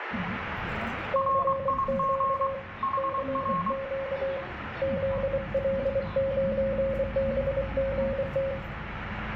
Morse code, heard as two keyed tones, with radio static, room echo and the noise inside a bus. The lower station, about 24 wpm, 540 Hz: CQ CQ ZL9BGT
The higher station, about 23 wpm, 1080 Hz: RIG HR